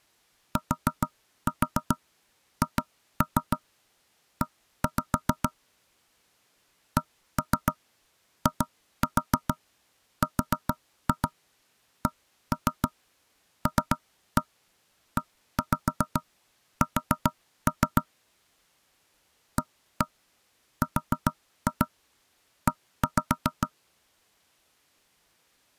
Tap code, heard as knocks on wood, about 7 knocks a second. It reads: THE CIRCLES ARE